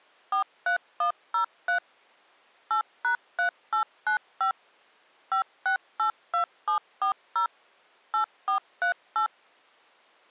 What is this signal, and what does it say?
DTMF, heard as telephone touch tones, dialled by machine, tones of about 100 ms. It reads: 43103 8#3895 5682740 8438